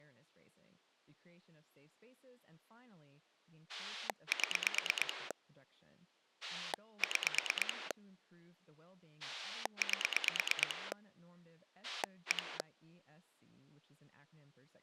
Pulse dialling, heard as a rotary dial, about 9 pulses a second, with speech in English. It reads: 7 6 8 1